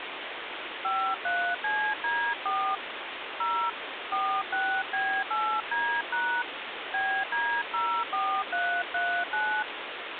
DTMF, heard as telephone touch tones, dialled by hand, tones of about 300 ms, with phone line noise. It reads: 53CD4 0 46B8D# BD04339